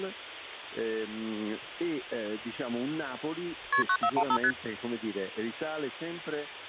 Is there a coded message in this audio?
Yes: multi-frequency trunk signalling (R1, as on North American trunks) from 3.7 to 4.5 s, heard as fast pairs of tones, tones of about 70 ms, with hum. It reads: KP 9415 ST